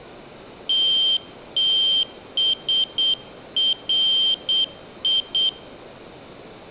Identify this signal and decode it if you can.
Morse code, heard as a high beeper, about 8 wpm, 3150 Hz. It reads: TTSRI